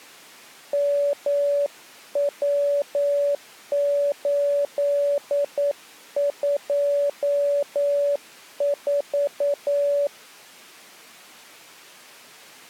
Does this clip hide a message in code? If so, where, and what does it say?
Yes: Morse code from 0.7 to 10.1 s, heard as a keyed tone, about 9 wpm, 570 Hz. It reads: MW824